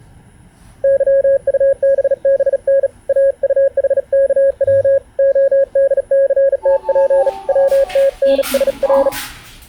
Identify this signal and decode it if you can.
Morse code, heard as a keyed tone, hand-sent with a bug key, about 37 wpm, 550 Hz, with the noise inside a lift. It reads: YUBBN AUHKW ODCTP WTNSR